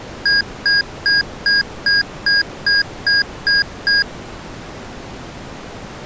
Beep code, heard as beeps from a small speaker, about 1650 Hz. 10 short. In AMI BIOS tables: CMOS shutdown register error.